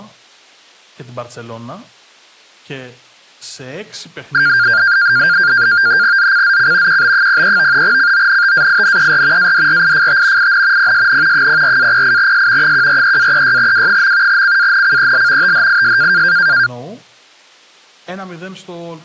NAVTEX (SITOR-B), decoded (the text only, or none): ZCZC QB03 CONTAINER ADRIFT IN PSN 04-08S 143-36W. CANCEL THIS